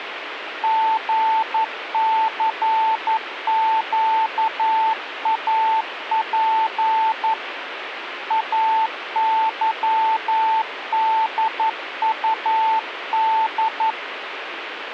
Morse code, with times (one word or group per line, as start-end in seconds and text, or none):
0.6-7.3 GCQAP
8.3-13.9 AYDUD